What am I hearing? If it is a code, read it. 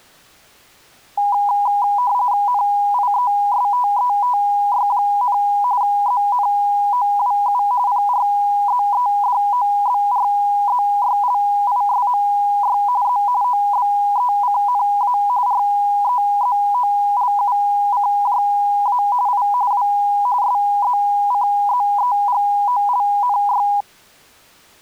RTTY (45.45 baud, 170 Hz shift), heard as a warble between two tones, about 900 Hz centre. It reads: NIESTETY, ZNOWU PRZEDOBRZYLISMY Z OBECNA REZOLUCJA I W SZCZEGOLNY